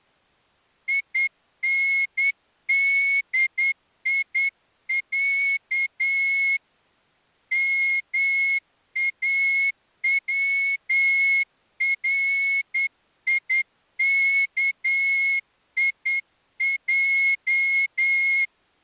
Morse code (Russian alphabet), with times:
0.9-6.6 ИНДИЯ
7.5-18.4 МАВРИКИЙ

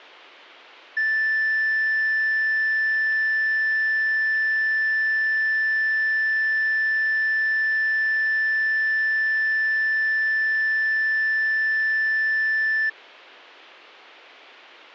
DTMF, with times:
none

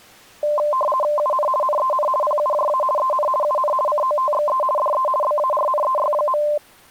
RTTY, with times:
1.2-1.5 UN
1.6-2.1 NEN
2.2-2.8 PUJA
3.0-3.3 EN
3.4-3.7 UN
3.9-4.6 COTXE
4.8-5.1 DE
5.2-6.4 BARNEY.

